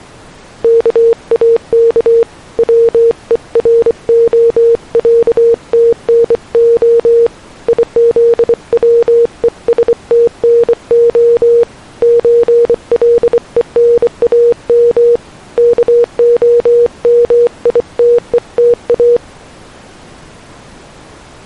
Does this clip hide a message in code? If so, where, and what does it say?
Yes: Morse code (Russian alphabet) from 0.6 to 19.2 s, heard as a keyed tone, hand-sent with a bug key, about 24 wpm, 470 Hz. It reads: КАК ВЕРОЯТНО ИЗВЕСТНО ЧЛЕНАМ КОМИТЕТА